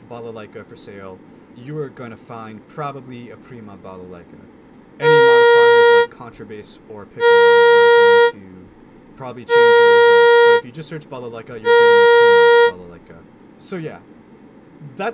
Ship horn signal, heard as a ship's horn, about 470 Hz, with speech in English. 4 short. At sea: a pilot vessel's identity signal in fog.